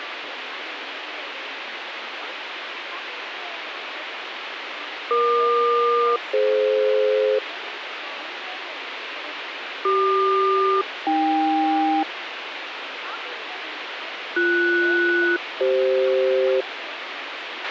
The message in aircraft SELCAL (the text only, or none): EQ-DF CQ-AK BS-CF